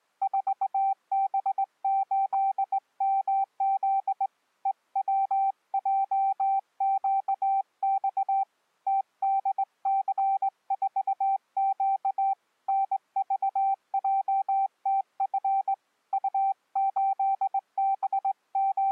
Morse code, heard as a keyed tone, hand-sent with a straight key, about 20 wpm, 780 Hz. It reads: 4B8MZ EWJQX TDC4Q NVJTF …